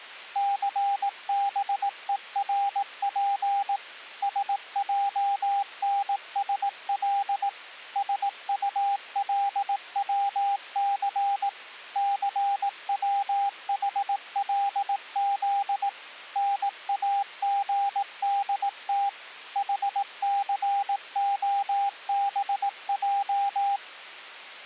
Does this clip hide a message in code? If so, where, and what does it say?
Yes: Morse code (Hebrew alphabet) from 0.3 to 23.8 s, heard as a keyed tone, machine-sent, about 18 wpm, 800 Hz. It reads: סבורף שענשל שטלצס סצחלז נאגדת חסהבע